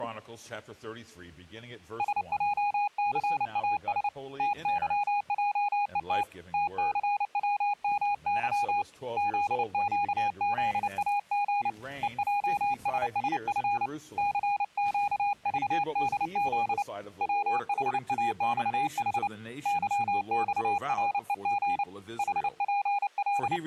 Morse code, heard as a keyed tone, hand-sent with a paddle, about 29 wpm, 820 Hz. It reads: SJCAS TYJET TCWMY ZQZAG EJSSF CQVDZ WHAXH YXREG …